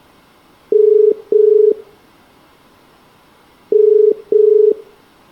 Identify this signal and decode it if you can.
Telephone call progress tone (as in the UK, Ireland, Australia and similar networks), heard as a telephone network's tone, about 430 Hz, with room echo. Ringback tone.